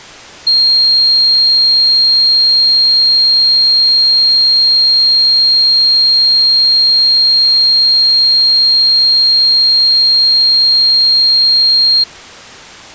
A steady tone. There is no code.